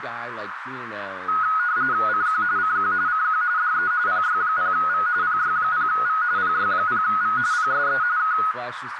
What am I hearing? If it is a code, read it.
RTTY (45.45 baud, 170 Hz shift), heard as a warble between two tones, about 1360 Hz centre, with radio static, a narrow filter and speech in English. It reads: CQ CQ CQ DE PY0V PY0V PY0V PSE K